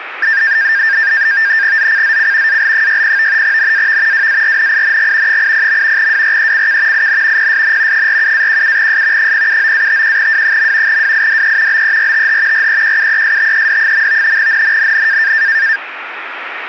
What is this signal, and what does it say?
NAVTEX (SITOR-B), 100 baud, 170 Hz shift, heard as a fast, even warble, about 1700 Hz centre, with radio static. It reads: ZCZC AL60 NAV WARNING 80. WRECK IN PSN 47-17S 079-51W. WIDE BERTH REQUESTED. NNNN